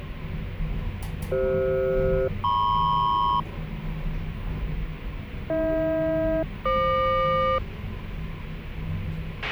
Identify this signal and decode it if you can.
Aircraft SELCAL, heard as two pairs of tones, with a squelch burst at the end and the noise inside a lift. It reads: CF-MP AH-FQ